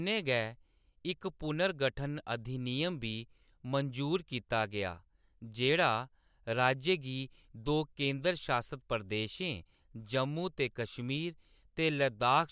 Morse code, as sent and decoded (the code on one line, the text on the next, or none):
none